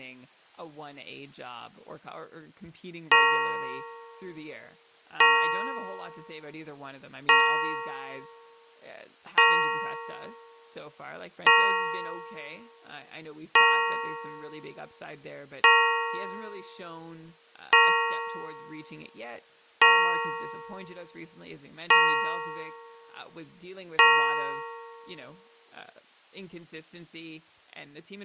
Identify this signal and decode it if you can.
Clock strike, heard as a bell, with speech in English. 11. Eleven o'clock.